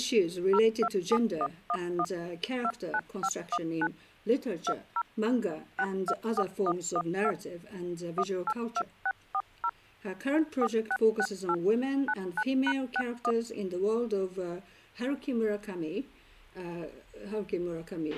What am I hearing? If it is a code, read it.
DTMF, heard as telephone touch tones, dialled by machine, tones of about 60 ms, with a squelch burst at the end. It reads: 027111 29519 20 624112 182640 4668 99#61